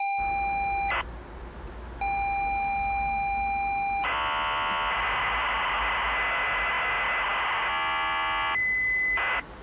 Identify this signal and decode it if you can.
ZX Spectrum tape loading, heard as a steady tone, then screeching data, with the noise inside a lift.